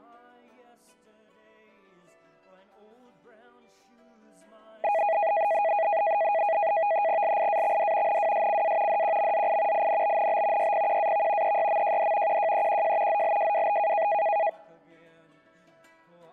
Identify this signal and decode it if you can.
NAVTEX (SITOR-B), 100 baud, 170 Hz shift, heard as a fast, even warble, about 740 Hz centre. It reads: LIAXD NWSCA DQMZI INBNB YPQAV EYMJD QJEQJ ZLJWB